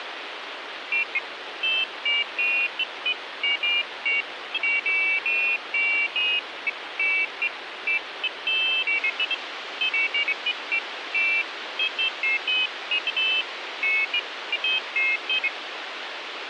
Pairs of high tones at irregular times, with radio hiss. There is no code.